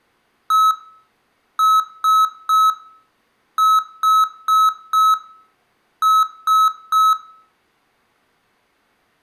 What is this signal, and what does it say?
Beep code, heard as beeps from a small speaker, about 1290 Hz, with room echo. 1-3-4-3. In Phoenix BIOS tables: memory failure on data bits.